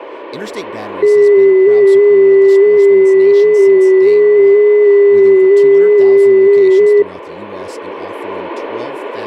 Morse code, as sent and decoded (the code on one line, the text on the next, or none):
none